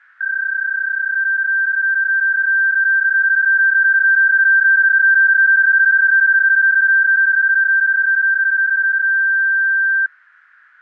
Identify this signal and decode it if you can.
PSK31 (31.25 baud), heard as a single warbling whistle, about 1550 Hz.